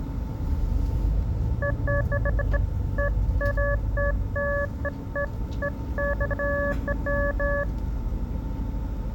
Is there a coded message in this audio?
No, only beeps of irregular length, with the noise inside a bus.